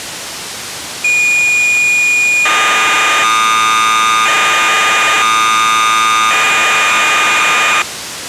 Cassette data (Kansas City type), 1200 baud, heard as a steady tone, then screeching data, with tape hiss.